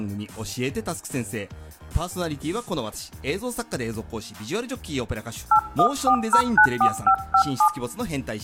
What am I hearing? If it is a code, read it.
DTMF, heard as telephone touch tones, dialled by hand, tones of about 80 ms. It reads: 814094557